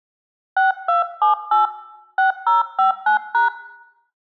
DTMF, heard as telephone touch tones, dialled by hand, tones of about 130 ms, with room echo. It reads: 6278 6059#